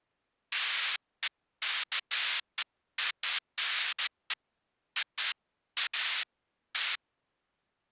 Bursts of noise. There is no code.